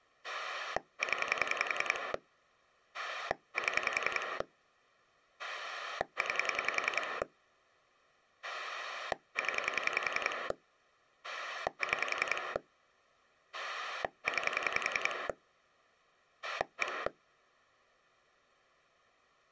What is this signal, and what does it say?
Pulse dialling, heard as a rotary dial, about 10 pulses a second. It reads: 0 7 9 0 6 9 1